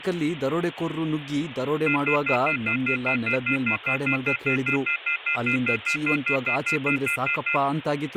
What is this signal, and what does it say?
Telephone call progress tone (North American plan), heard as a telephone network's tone, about 1400, 2050, 2450, 2600 Hz, 0.1 s on and 0.1 s off, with phone line noise and speech in Kannada. Off-hook warning tone.